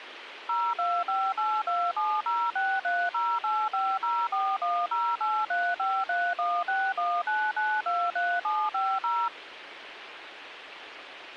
DTMF, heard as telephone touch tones, dialled by machine, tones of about 240 ms, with radio hiss and a squelch burst at the end. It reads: 025827063085041083531619923750